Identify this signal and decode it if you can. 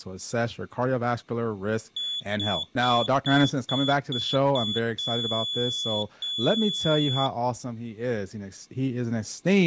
Beep code, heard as a piezo beeper, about 3450 Hz, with speech in English. 7 short, 2 long.